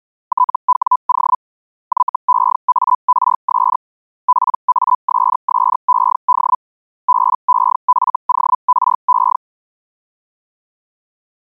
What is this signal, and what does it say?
Hellschreiber (Feld-Hell, 122.5 baud), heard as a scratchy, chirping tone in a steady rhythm, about 1000 Hz. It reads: TWO YEARS PASSED BEFORE